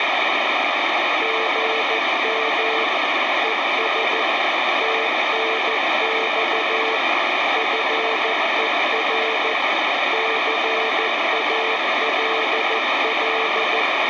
Morse code, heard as a keyed tone, machine-sent, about 14 wpm, 450 Hz, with radio static. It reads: GM ES TNX FER CALL